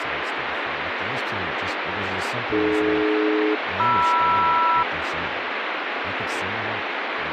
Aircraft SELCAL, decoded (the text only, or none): AD-MR